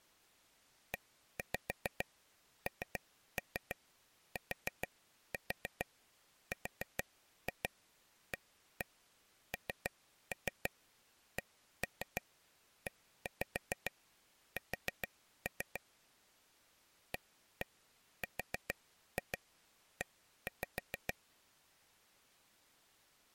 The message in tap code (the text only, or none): ENTRANCES ARE